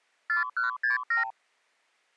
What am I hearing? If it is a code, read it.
Multi-frequency trunk signalling (R2, with the far end's replies), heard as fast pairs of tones, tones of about 130 ms. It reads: 4167